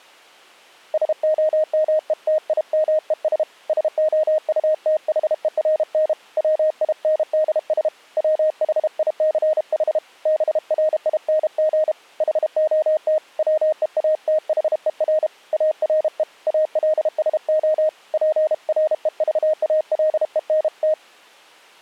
Morse code, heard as a keyed tone, hand-sent with a paddle, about 32 wpm, 620 Hz. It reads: SOMETIMES SOUTHERN WINDS WHICH BRING HOT WEATHER ARE ALSO PREVALENT